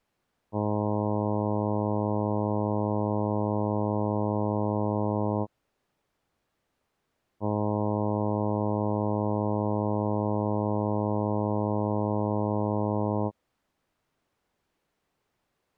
Ship horn signal, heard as a ship's horn, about 100 Hz. 2 long. At sea: a vessel under power that has stopped in fog.